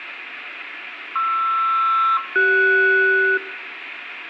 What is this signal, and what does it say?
Aircraft SELCAL, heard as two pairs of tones, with radio static and room echo. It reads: PR-CS